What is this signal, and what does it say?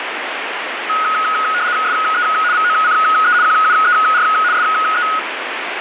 RTTY (75 baud, 170 Hz shift), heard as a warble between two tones, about 1360 Hz centre, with radio static. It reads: SE VOCE QUER SE